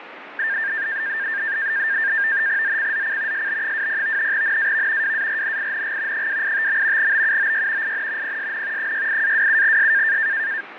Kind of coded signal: NAVTEX (SITOR-B)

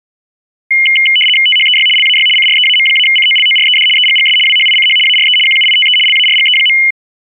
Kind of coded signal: RTTY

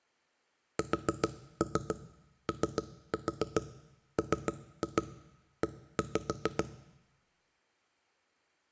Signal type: tap code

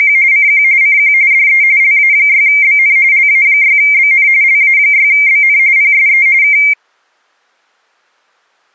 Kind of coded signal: RTTY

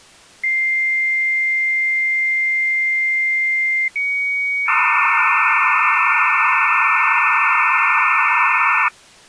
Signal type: dial-up modem handshake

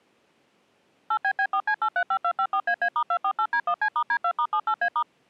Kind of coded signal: DTMF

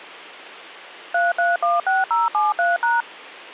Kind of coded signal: DTMF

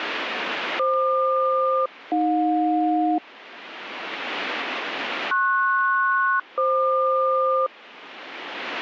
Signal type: aircraft SELCAL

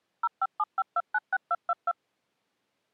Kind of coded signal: DTMF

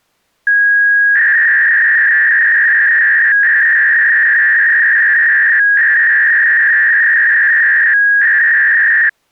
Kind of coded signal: 300-baud modem data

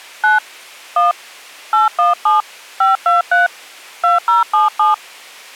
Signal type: DTMF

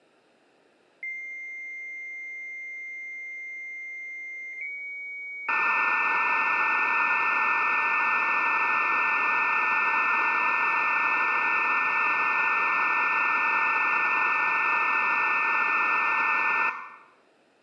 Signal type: dial-up modem handshake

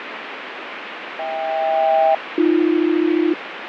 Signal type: aircraft SELCAL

